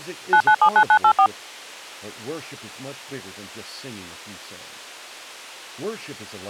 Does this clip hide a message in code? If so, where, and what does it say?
Yes: DTMF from 0.3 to 1.3 s, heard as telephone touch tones, dialled by machine, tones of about 80 ms, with speech in English. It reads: 9979984